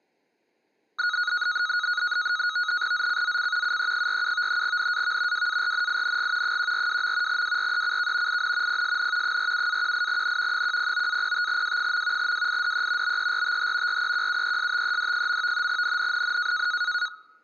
NAVTEX (SITOR-B), 100 baud, 170 Hz shift, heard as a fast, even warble, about 1360 Hz centre. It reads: ZCZC UE47 NAV WARNING 142. WRECK IN PSN 47-18N 109-05W. WIDE BERTH REQUESTED. NNNN